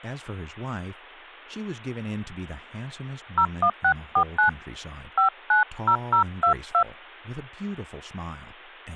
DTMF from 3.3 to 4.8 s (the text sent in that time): 01649